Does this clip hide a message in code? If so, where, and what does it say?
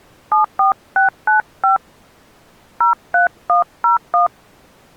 Yes: DTMF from 0.3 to 4.3 s, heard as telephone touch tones, dialled by hand, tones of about 130 ms. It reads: 74695 03101